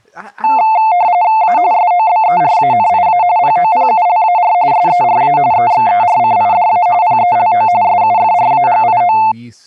RTTY (45.45 baud, 170 Hz shift), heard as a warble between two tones, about 790 Hz centre, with speech in English. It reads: A SOBERANIA POPULAR SERA EXERCIDA PELO SUFRAGIO